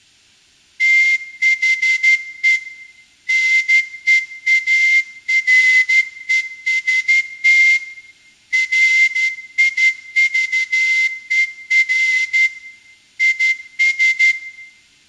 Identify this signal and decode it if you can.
Morse code, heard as a whistle, hand-sent with a straight key, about 12 wpm, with room echo. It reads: THE NEAREST RIVER IS